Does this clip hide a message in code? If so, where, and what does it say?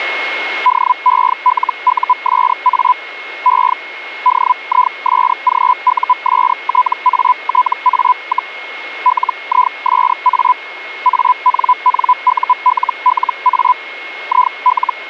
Yes: Hellschreiber (Feld-Hell, 122.5 baud) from 0.7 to 14.9 s, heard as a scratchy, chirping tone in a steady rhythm, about 1000 Hz, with a steady whistle near 2160 Hz. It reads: DELUSA E DISGUSTATA, LISA ANNULLA IL